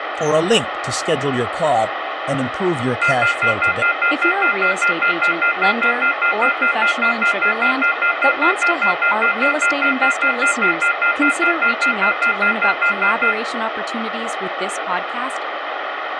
Telephone call progress tone (North American plan), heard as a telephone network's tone, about 1400, 2050, 2450, 2600 Hz, 0.1 s on and 0.1 s off, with phone line noise, room echo and speech in English. Off-hook warning tone.